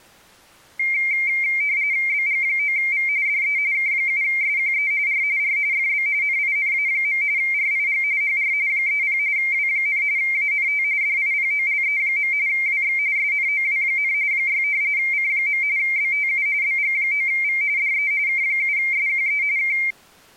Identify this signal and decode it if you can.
RTTY (45.45 baud, 170 Hz shift), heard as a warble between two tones, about 2200 Hz centre. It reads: BG9V DE K7SQE R R FB NINA. RIG HR 30 W, ANT DIPOLE. WX SNOW, 6 C. BTU BG9V DE K7SQE K